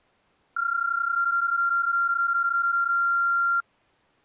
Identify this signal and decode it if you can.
PSK31 (31.25 baud), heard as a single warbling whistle, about 1380 Hz.